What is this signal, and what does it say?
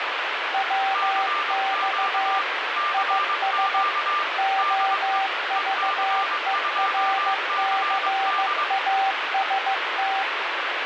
Morse code, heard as two keyed tones, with heavy radio static. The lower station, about 15 wpm, 780 Hz: WX IS OVERCAST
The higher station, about 22 wpm, 1190 Hz: CQ CQ DE EC2CD